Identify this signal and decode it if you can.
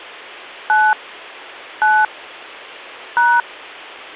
DTMF, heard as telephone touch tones, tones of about 230 ms. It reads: 9 9 #